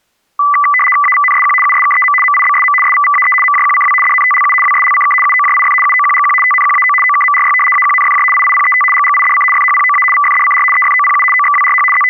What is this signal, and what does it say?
RTTY (75 baud, 850 Hz shift), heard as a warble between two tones, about 1600 Hz centre. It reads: AVNSQ USKEM MIBSM SVVAE MJQCW DNTLU WSLCK UOJIF UOQGQ TNQAO OKMRY AQNFJ IIPET GGIDC FHPOA VFDCR EFOPU OXWRH …